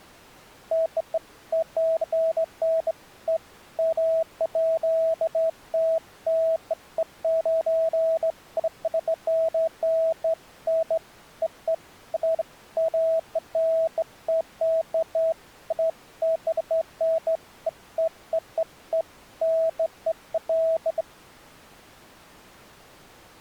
Beeps of irregular length. There is no code.